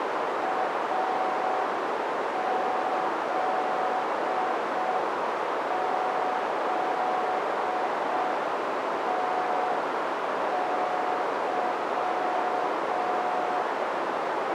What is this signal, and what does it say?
Morse code, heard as a keyed tone, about 5 wpm, 740 Hz, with heavy radio static and a narrow filter. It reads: AZZTY